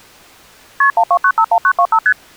Multi-frequency trunk signalling (R1, as on North American trunks), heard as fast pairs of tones, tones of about 70 ms. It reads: KP 12951925 ST